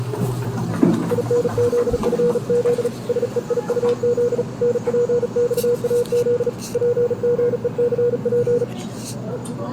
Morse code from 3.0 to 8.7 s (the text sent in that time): SEIUZ NPXAZ PGECP